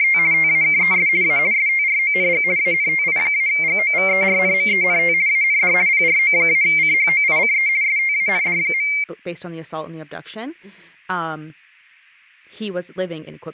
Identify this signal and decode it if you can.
RTTY (50 baud, 170 Hz shift), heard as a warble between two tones, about 2200 Hz centre, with speech in English. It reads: … TAKES A STRONG ANTI-GOVERNMENT AND PRO-CHOICE STAND.